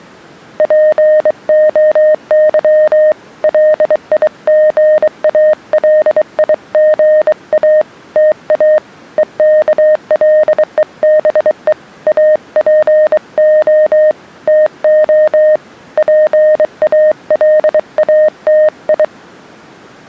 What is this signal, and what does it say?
Morse code (Greek alphabet), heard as a keyed tone, hand-sent with a bug key, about 23 wpm, 620 Hz. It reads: ΠΟΥ ΛΙΓΑΛΙΓΑ ΤΑ ΕΚΛΕΒΕ ΑΠΟ ΤΟ ΠΑΛΑΤΙ